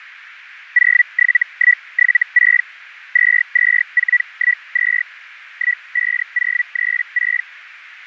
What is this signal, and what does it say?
Hellschreiber (Feld-Hell, 122.5 baud), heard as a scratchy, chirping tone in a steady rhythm, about 1950 Hz, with radio static. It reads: 07176 22412 15036